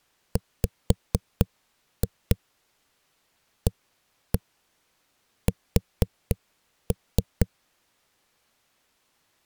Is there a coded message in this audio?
Yes: tap code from 0.4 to 7.5 s, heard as knocks on a wall, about 4 knocks a second. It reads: WAS